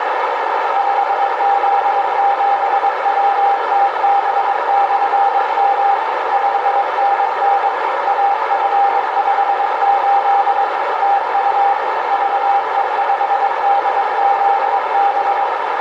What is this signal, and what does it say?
Morse code, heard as a keyed tone, machine-sent, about 22 wpm, 800 Hz, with heavy radio static and a narrow filter. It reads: 5Z7WTB/M 5NN AF58 TU VE5DZB